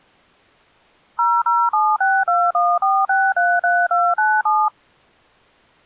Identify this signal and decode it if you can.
DTMF, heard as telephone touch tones, dialled by machine, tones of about 230 ms. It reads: 0076214633297